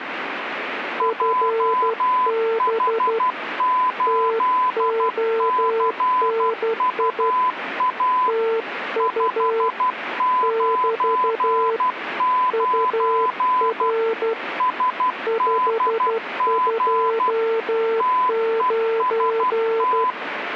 Morse code, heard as two keyed tones, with radio static. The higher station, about 12 wpm, 1010 Hz: JH8CUA 599 SDG TEST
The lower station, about 12 wpm, 450 Hz: FB TONI TU <BT> UR 529